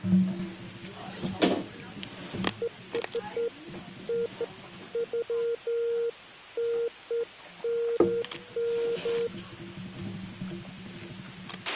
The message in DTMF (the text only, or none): none